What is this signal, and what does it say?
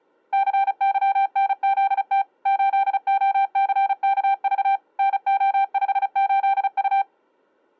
Morse code, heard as a keyed tone, machine-sent, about 35 wpm, 790 Hz. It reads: CYNZT 8OCKV NO58U